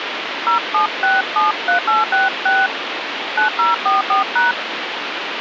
DTMF, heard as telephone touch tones, dialled by hand, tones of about 160 ms, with phone line noise. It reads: 07673866 9044#